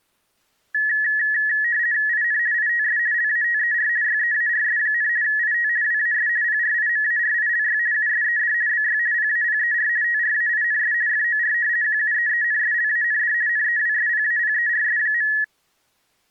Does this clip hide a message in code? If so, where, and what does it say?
Yes: RTTY (50 baud, 170 Hz shift) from 0.7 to 15.4 s, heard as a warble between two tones, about 1800 Hz centre. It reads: IN ITS LATER YEARS, IT WAS PRIMARILY USED BY PAPER TRAINS FOR QUEENSLAND NEWSPAPERS.